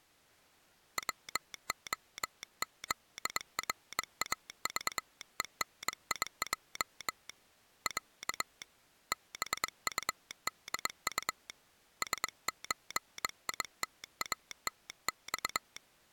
Morse code (Russian alphabet), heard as a telegraph sounder, hand-sent with a bug key, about 22 wpm. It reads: ВОЗРАЖЕНИЙ Я БУДУ СЧИТАТЬ